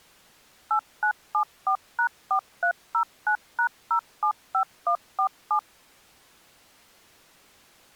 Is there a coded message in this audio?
Yes: DTMF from 0.7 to 5.6 s, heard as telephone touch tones, dialled by machine, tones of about 90 ms. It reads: 8974#4309#075147